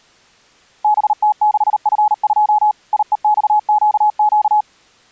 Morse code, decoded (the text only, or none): BT6F2 IEXQQ